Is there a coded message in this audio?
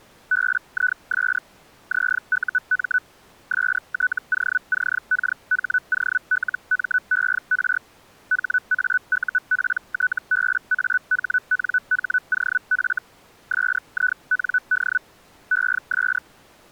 Yes: Hellschreiber (Feld-Hell, 122.5 baud) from 0.3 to 16.2 s, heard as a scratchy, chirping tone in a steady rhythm, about 1490 Hz. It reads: BIS ZUM STOCKHOLMER HAUPTBAHNHOF SIND ES